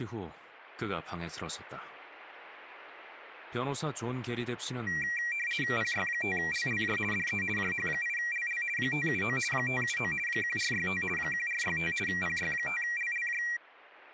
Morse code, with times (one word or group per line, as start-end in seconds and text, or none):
none